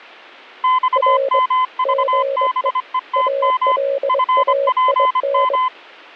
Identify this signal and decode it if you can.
Morse code, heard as two keyed tones. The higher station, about 25 wpm, 1020 Hz: XMVBETM FPM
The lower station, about 23 wpm, 550 Hz: R GE ALAIN